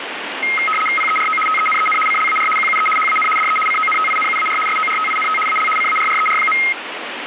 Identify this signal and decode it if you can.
RTTY (75 baud, 850 Hz shift), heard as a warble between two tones, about 1700 Hz centre, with radio static. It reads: PERO TENEN CLAR QUE HAN DE CONTINUAR SORTINT AL CARRER.